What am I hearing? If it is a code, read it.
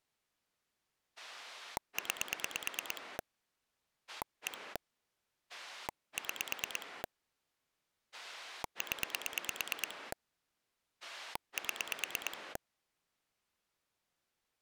Pulse dialling, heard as a rotary dial, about 9 pulses a second. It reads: 9 1 6 0 7